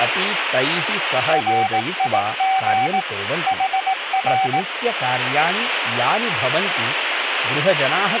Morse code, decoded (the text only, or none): RIG HR